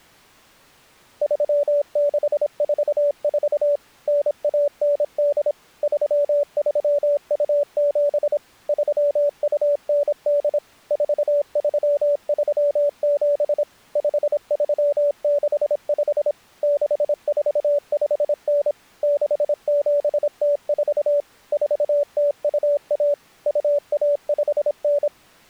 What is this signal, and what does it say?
Morse code (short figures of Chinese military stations), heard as a keyed tone, machine-sent, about 26 wpm, 580 Hz. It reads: 3644 9198 3327 3298 4337 5365 6459 6704 4021 2159